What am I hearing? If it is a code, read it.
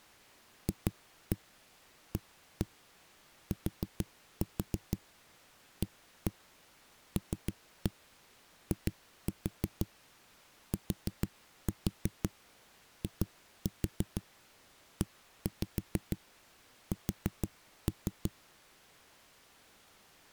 Tap code, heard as knocks on a wall, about 6 knocks a second. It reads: FATALITIES